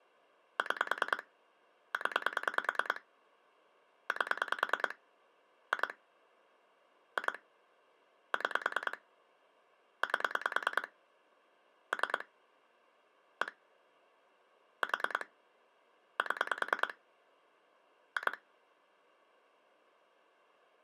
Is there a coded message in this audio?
Yes: pulse dialling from 0.6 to 18.3 s, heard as clicks on a phone line, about 10 pulses a second. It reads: 6 0 8 2 2 6 8 3 1 4 7 2